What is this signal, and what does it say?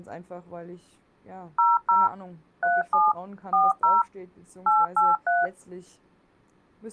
DTMF, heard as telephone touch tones, dialled by machine, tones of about 190 ms, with speech in German. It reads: 00 37 40 883